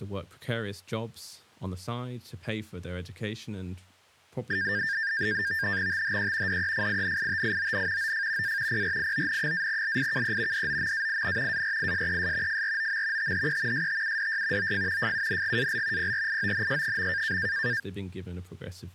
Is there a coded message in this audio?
Yes: NAVTEX (SITOR-B), 100 baud, 170 Hz shift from 4.5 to 17.8 s, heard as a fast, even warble, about 1700 Hz centre, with speech in English. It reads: THE DEFINITION OF A PRION-LIKE DOMAIN ARISES FROM THE STUDY OF FUNGAL PRIONS.